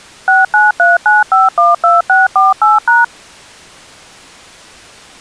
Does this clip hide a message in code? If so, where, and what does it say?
Yes: DTMF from 0.3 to 3.0 s, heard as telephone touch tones, dialled by machine, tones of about 170 ms. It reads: 6939512648#